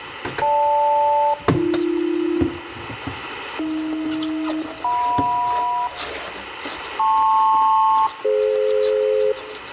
Aircraft SELCAL, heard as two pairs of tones, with radio static, a steady whistle near 1950 Hz, room echo and kitchen noise. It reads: GL-AB AH-JM LP-DF